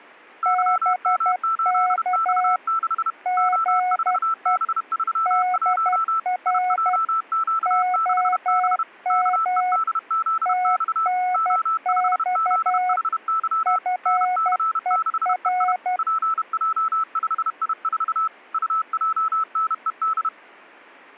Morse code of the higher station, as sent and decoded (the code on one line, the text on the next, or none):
-.-- -- ---.. -..- -.... / --- ....- -... ...-- .---- / .. .--- --.- -.... -... / -.- . -.. --.. -..- / --- ..... --.. .... -.-- / -. -.-. -.... . .. / .--. .--- ..... .. ....- / ..- .--- -. . -..
YM8X6 O4B31 IJQ6B KEDZX O5ZHY NC6EI PJ5I4 UJNED